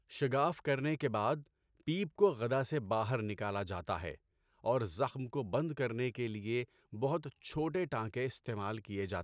Speech in Urdu. There is no code.